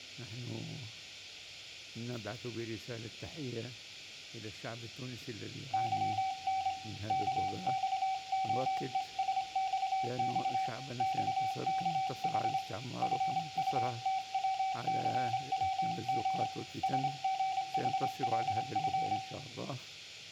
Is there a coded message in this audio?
Yes: Morse code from 5.7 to 19.2 s, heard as a keyed tone, hand-sent with a straight key, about 26 wpm, 770 Hz, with room echo. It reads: YN KXOESXX XKH FUTWCWG SGHLF